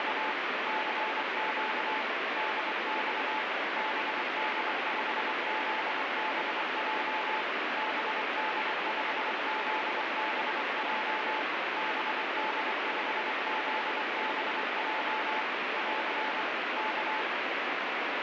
Morse code, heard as a keyed tone, machine-sent, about 24 wpm, 870 Hz, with heavy radio static. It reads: … CQ DX BD5ZBJ BD5ZBJ BD5ZBJ <AR> K